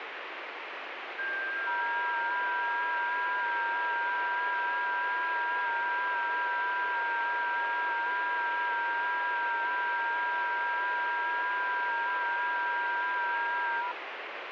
FT8 (several signals at once), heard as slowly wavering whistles, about 6.25 baud, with radio static.